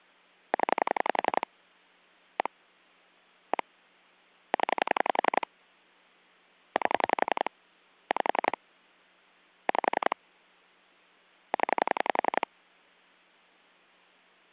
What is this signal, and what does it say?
Pulse dialling, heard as clicks on a phone line, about 11 pulses a second. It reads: 0 1 1 0 8 5 5 0